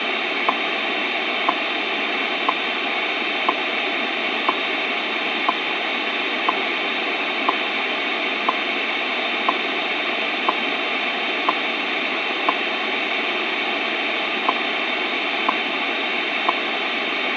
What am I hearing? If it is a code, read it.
Radio time signal (WWV, Colorado), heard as ticks, one a second, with radio static.